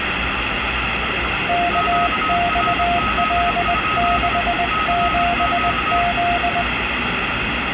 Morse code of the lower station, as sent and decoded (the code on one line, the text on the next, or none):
-.- -..- .-.. -.... --... --..
KXL67Z